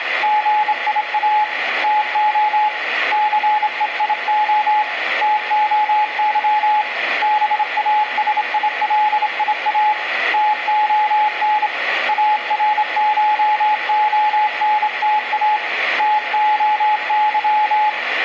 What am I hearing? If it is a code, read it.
Morse code (Greek alphabet), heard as a keyed tone, hand-sent with a straight key, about 27 wpm, 850 Hz, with radio static and room echo. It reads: ΓΙΑ ΤΟ ΘΕΙΟ ΤΟΥ ΒΑΣΙΛΙΑ ΤΟΝ ΑΡΧΟΝΤΑ ΤΟΥ